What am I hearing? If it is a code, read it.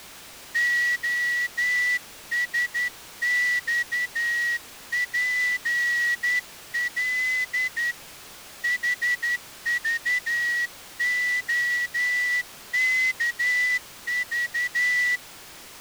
Morse code, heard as a whistle, hand-sent with a straight key, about 11 wpm. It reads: OSXPL HVOKV